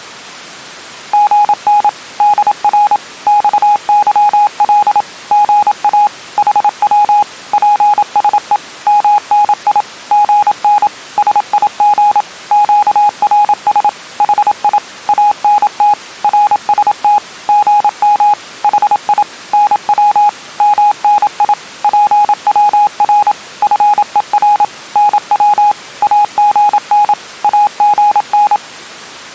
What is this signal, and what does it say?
Morse code, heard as a keyed tone, machine-sent, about 27 wpm, 830 Hz. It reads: GN DR XYL GA HW PSE MNI GN SIG QRS HI ANT RST GM HI NW MNI PWR FER NW AGN AGN